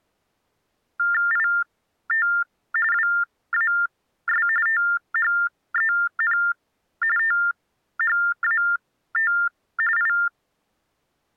TTY/TDD text telephone tones (45.45 baud Baudot), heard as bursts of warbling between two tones, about 400 Hz shift, 1600 Hz centre. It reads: IT WAS THEN THAT I